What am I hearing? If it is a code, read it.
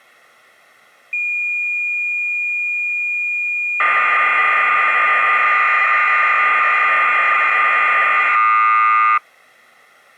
Cassette data (Kansas City type), 1200 baud, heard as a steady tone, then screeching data.